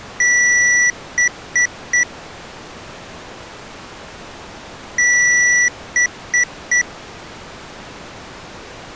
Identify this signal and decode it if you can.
Beep code, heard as beeps from a small speaker, played twice, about 1950 Hz. 1 long, 3 short. In Award and IBM BIOS tables: video adapter failure; in AMI BIOS tables: memory failure.